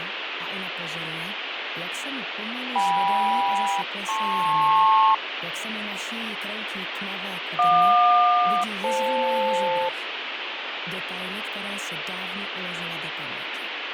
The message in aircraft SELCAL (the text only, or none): KM-LP JQ-FL